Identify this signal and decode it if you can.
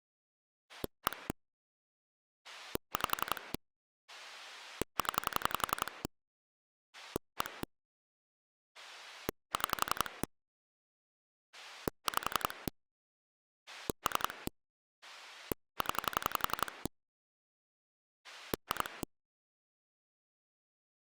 Pulse dialling, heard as a rotary dial, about 11 pulses a second. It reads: 1 5 0 1 6 5 3 0 2